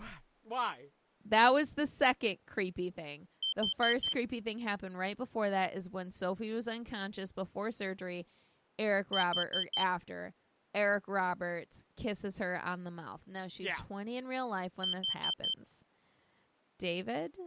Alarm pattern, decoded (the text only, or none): temporal four